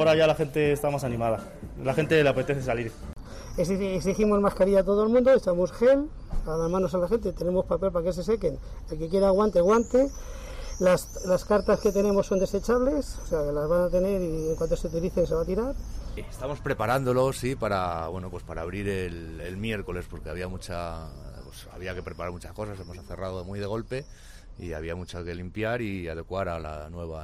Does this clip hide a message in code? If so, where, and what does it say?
No.